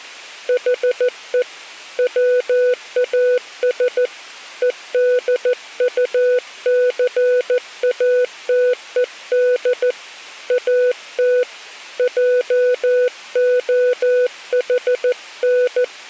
Morse code, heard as a keyed tone, hand-sent with a paddle, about 14 wpm, 500 Hz. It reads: HE WAS EDUCATED AT JOHN